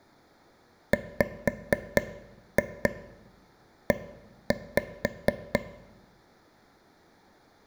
Tap code, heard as taps on a table, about 4 knocks a second, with room echo. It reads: WE